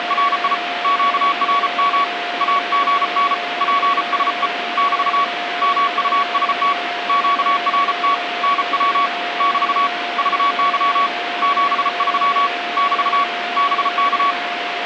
Morse code, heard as a keyed tone, hand-sent with a paddle, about 34 wpm, 1130 Hz, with radio static and a steady whistle near 700 Hz. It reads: … QRM AGN PSE <BT> MUST QRT NW <BT> VY 73 <BT> BK